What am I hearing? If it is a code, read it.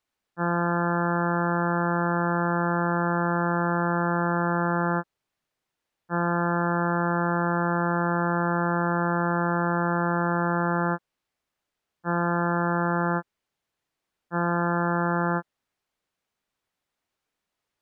Ship horn signal, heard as a ship's horn, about 170 Hz. 2 long, 2 short. At sea: I intend to overtake on your port side.